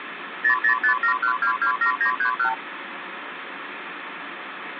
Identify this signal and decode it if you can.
Multi-frequency trunk signalling (R2, with the far end's replies), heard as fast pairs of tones, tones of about 100 ms, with phone line noise. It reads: 00571227931